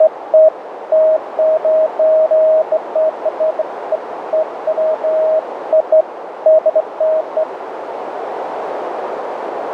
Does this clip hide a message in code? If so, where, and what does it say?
No, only beeps of irregular length, with radio static and a narrow filter.